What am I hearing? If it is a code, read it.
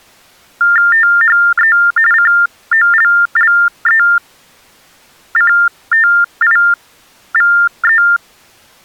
TTY/TDD text telephone tones (45.45 baud Baudot), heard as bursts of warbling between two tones, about 400 Hz shift, 1600 Hz centre. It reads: THE COLLECTIVE